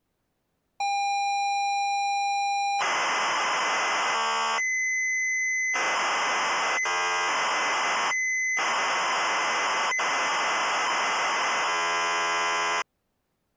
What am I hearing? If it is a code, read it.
ZX Spectrum tape loading, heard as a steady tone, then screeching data.